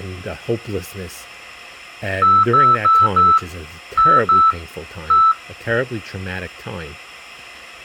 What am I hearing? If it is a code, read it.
Beep code, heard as beeps, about 1320 Hz, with speech in English. 4-2-1. In Phoenix BIOS tables: timer tick failure.